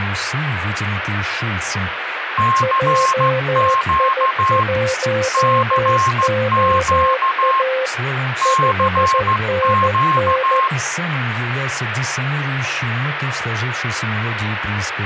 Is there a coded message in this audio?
Yes: Morse code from 2.3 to 10.7 s, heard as two keyed tones, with radio static. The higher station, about 14 wpm, 1060 Hz: CQ CQ CQ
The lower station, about 14 wpm, 520 Hz: JI1OA 5NN